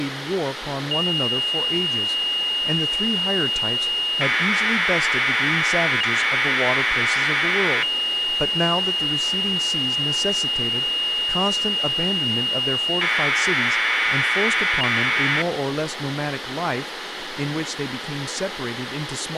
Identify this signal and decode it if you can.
Commodore tape loading (standard loader), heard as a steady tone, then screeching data, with tape hiss and speech in English.